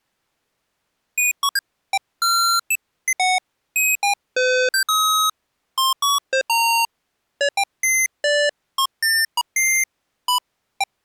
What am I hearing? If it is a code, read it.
Electronic bleeps of random pitch and length. There is no code.